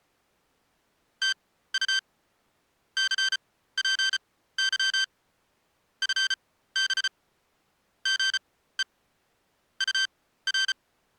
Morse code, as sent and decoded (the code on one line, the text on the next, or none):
- ..- / -.-. .--. -.-- / ..-. -... / --. . / ..- .-.
TU CPY FB GE UR